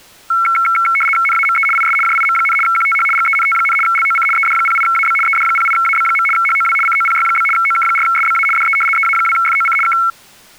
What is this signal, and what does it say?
RTTY (75 baud, 850 Hz shift), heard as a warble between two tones, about 1800 Hz centre. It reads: NAME IS JIM, QTH GENT, LOC ED08AB ED08AB. HOW COPY? OK4SBA DE EA2FOC K